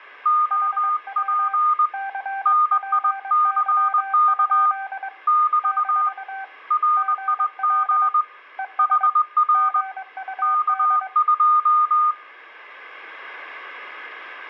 Morse code, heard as two keyed tones, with room echo. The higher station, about 20 wpm, 1220 Hz: OP NICK <BT> RIG HR K2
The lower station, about 22 wpm, 780 Hz: HW CPY? - GL ES GUD